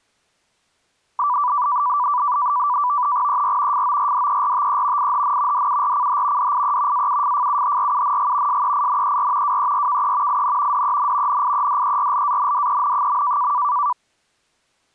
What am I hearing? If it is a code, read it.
NAVTEX (SITOR-B), 100 baud, 170 Hz shift, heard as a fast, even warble, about 1080 Hz centre. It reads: ER FORDERTE IHN DURCH DIE AUFFUHRUNG SEINER WERKE IN DEN NIEDERLANDEN.